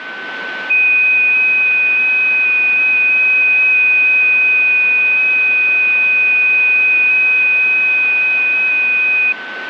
FT8 (one signal), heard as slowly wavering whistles, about 6.25 baud, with radio static and a steady whistle near 1520 Hz.